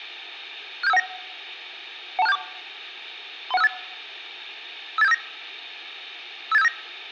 Five-tone selective call (EIA), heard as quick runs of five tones, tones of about 30 ms. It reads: 67519 12674 31658 58759 58759